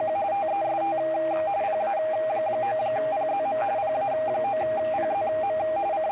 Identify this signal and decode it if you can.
RTTY (45.45 baud, 170 Hz shift), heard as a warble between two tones, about 720 Hz centre, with radio static and a narrow filter. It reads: … TEST PA9PZM PA9PZM …